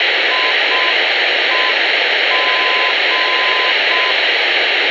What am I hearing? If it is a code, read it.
Morse code, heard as a keyed tone, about 6 wpm, 1020 Hz, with radio hiss and room echo. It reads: IEG